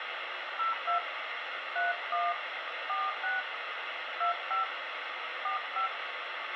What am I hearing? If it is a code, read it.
DTMF, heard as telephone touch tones, dialled by hand, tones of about 140 ms, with radio hiss and a squelch burst at the end. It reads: 02 31 46 25 45